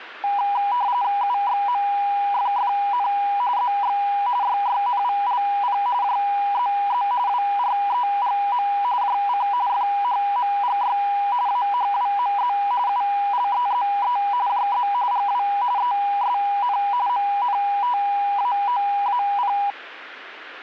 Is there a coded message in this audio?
Yes: RTTY (45.45 baud, 170 Hz shift) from 0.2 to 19.7 s, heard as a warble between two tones, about 890 Hz centre. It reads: UXMFFN ZX YYNVLP JZZ WREGM JC FHMGY AHWMZ ULEZE JZ GW ESN MNTAOAP